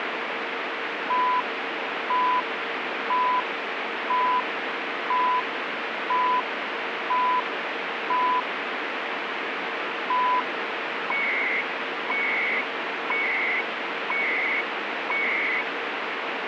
Radio time signal (CHU, Canada), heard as beeps and data bursts, one a second, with radio static.